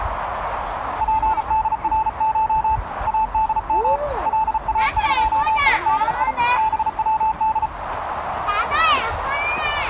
Morse code (Persian alphabet), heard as a keyed tone, hand-sent with a paddle, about 35 wpm, 880 Hz, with radio static and the noise of a park. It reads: پدرش ادم لاقیدی بود